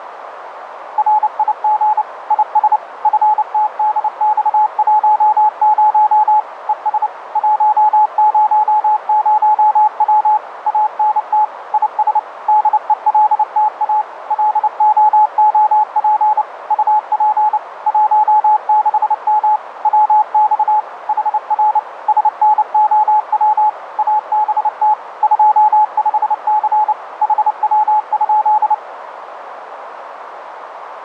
Morse code, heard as a keyed tone, machine-sent, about 29 wpm, 850 Hz, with radio static and a narrow filter. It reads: RIG IS FTDX10 ES 100W ANT IS DELTA LOOP UP 16M WX HR SNOW ABT 25C HW?